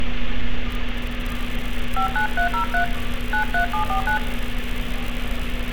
DTMF, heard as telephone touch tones, dialled by hand, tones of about 100 ms, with street noise. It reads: 59303 93749